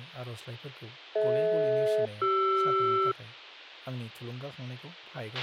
Aircraft SELCAL, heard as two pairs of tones, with a squelch burst at the end and speech in Bodo. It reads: DH-CR